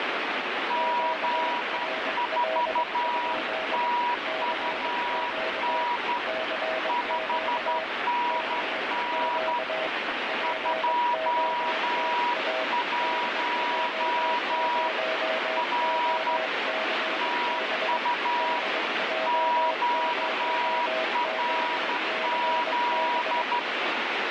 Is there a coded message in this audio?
Yes: Morse code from 0.6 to 23.7 s, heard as two keyed tones, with heavy radio static. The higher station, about 12 wpm, 970 Hz: G4TUN 5NN 21 R TU QRZ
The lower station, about 22 wpm, 640 Hz: QRL? CQ CQ CQ POTA DJ0OCB DJ0OCB